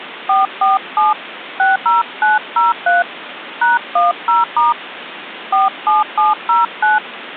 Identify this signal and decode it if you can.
DTMF, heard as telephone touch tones, dialled by hand, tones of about 160 ms, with phone line noise. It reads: 447 60903 #10* 47709